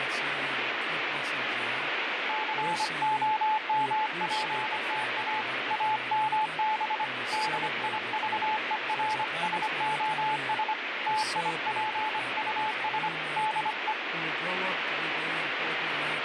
Morse code, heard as a keyed tone, hand-sent with a bug key, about 25 wpm, 860 Hz, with heavy radio static. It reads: COMPTA AMB DIVERSOS TIPUS DE